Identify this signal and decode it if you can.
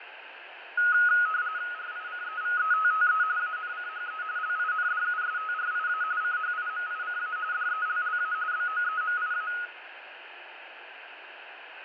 RTTY (45.45 baud, 170 Hz shift), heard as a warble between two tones, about 1360 Hz centre, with radio static, fading and room echo. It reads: RICEVETTE ANCHE LINDUSTRIA CHIMICA DELLA BOEMIA